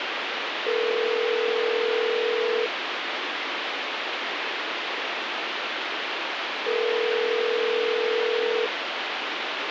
Telephone call progress tone (North American plan), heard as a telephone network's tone, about 440, 480 Hz, 2 s on and 4 s off, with phone line noise. Ringback tone.